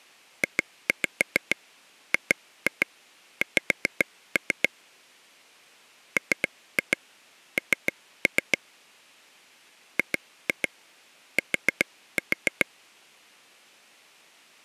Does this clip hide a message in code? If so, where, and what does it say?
Yes: tap code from 0.4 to 12.6 s, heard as taps on a table, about 7 knocks a second. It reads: JGX MN GT